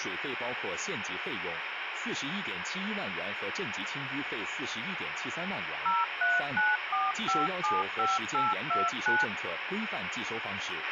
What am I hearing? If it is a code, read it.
DTMF, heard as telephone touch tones, dialled by machine, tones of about 190 ms, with radio hiss and a squelch burst at the end. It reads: 0394575829